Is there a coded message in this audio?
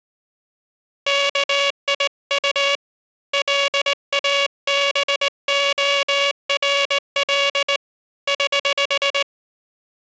Yes: Morse code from 1.0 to 9.3 s, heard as a buzzer, hand-sent with a straight key, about 19 wpm. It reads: KIU LABORL <HH>